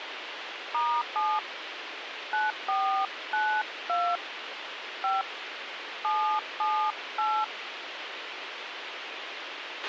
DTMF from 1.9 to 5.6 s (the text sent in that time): 9492 5